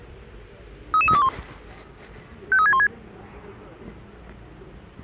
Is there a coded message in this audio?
Yes: five-tone selective call (ZVEI) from 0.9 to 2.9 s, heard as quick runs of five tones, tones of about 70 ms, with the noise of a residential street. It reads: 33321 53616